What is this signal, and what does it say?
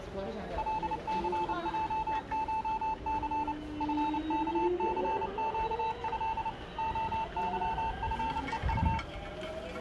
Morse code (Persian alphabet), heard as a keyed tone, machine-sent, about 29 wpm, 890 Hz, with the noise of a subway station. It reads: لثجشث فکثگض عظفهط